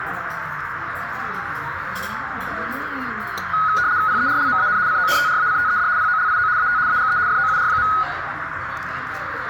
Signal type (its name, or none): RTTY